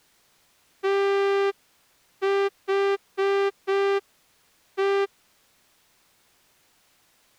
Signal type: Morse code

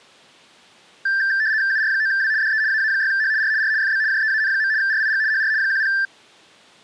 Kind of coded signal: RTTY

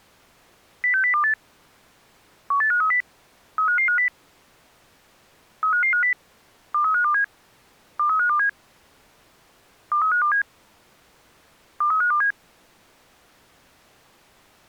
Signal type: five-tone selective call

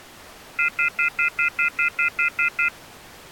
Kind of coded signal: telephone call progress tone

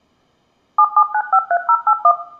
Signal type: DTMF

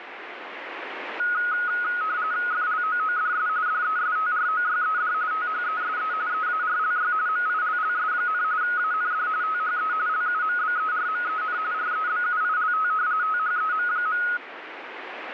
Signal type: RTTY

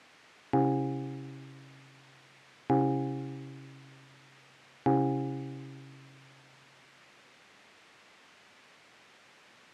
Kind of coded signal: clock strike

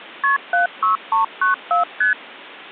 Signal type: multi-frequency trunk signalling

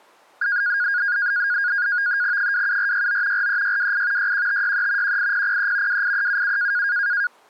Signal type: NAVTEX (SITOR-B)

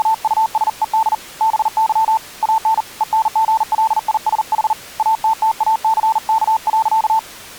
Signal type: Morse code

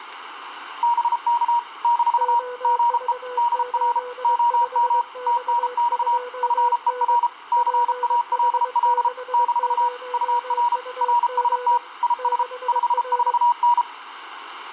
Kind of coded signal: Morse code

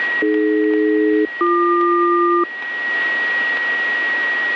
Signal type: aircraft SELCAL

